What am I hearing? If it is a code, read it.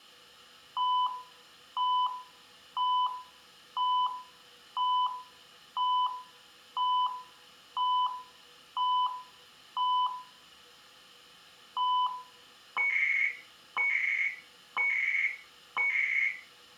Radio time signal (CHU, Canada), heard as beeps and data bursts, one a second, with room echo.